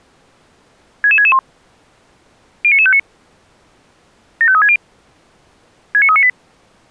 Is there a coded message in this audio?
Yes: five-tone selective call (ZVEI) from 1.0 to 6.3 s, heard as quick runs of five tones, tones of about 70 ms. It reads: 66661 09959 75360 69398